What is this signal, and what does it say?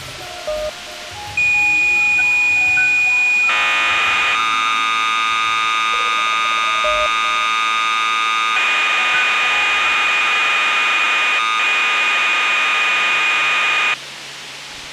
Cassette data (Kansas City type), 1200 baud, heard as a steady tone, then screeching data, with tape hiss.